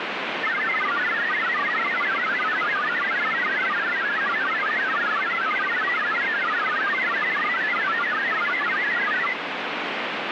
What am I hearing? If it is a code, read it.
Multi-tone FSK (Olivia or MFSK type), about 1000 Hz wide, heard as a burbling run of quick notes, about 62.5 baud, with radio static.